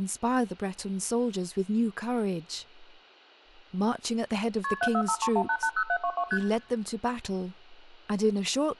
Multi-frequency trunk signalling (R1, as on North American trunks), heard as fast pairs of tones, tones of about 70 ms, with room echo and speech in English. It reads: KP 74531880722 ST